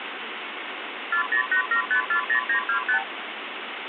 Multi-frequency trunk signalling (R2, with the far end's replies), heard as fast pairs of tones, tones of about 100 ms, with phone line noise. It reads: 4087540925